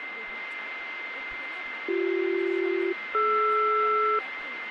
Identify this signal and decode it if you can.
Aircraft SELCAL, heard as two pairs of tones, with radio static, a steady whistle near 2080 Hz and speech in Bangla. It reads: BC-DR